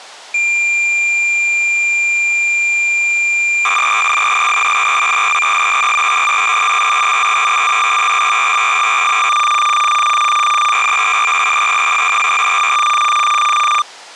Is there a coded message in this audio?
Yes: cassette data (Kansas City type), 300 baud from 0.3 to 13.8 s, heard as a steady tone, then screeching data.